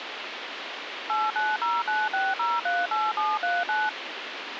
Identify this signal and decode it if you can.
DTMF, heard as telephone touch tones, dialled by machine, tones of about 200 ms, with radio hiss. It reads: 89096038739